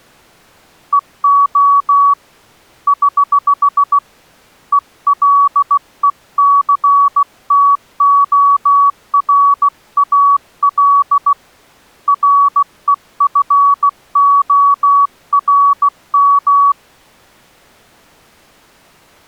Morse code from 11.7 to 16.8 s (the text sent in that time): REFORM